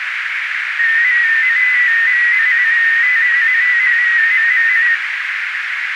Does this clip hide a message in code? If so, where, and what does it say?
Yes: multi-tone FSK (Olivia or MFSK type), about 250 Hz wide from 0.8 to 4.9 s, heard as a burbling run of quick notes, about 15.625 baud, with radio static and a narrow filter.